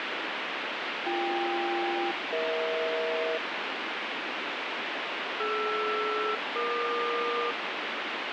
Aircraft SELCAL, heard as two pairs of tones, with heavy radio static. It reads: BK-EH DR-EQ